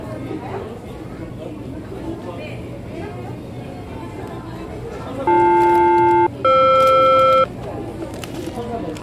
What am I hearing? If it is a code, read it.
Aircraft SELCAL, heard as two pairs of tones, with the noise of a crowd indoors. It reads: BL-FR